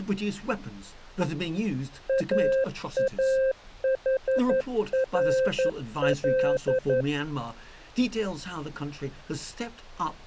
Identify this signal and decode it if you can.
Morse code (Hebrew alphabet), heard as a keyed tone, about 11 wpm, 520 Hz. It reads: אאחרל